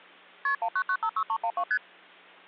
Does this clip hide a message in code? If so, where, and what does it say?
Yes: multi-frequency trunk signalling (R1, as on North American trunks) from 0.4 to 1.8 s, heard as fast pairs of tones, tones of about 70 ms, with hum. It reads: KP 19956312 ST